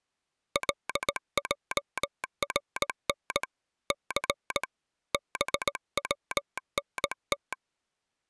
Morse code, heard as a telegraph sounder, hand-sent with a paddle, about 18 wpm. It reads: LJRN C BWNT